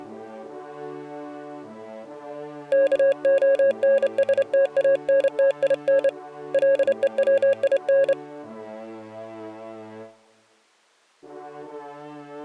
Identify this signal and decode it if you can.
Morse code (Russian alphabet), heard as a keyed tone, hand-sent with a straight key, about 28 wpm, 550 Hz. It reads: КОНСТАНТИН ЛЕВИН